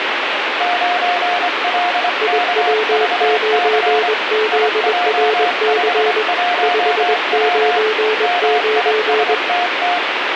Morse code, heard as two keyed tones, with radio static. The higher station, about 25 wpm, 710 Hz: 9LKVC IJ51W MISTT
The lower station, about 21 wpm, 430 Hz: IW9ZRC 599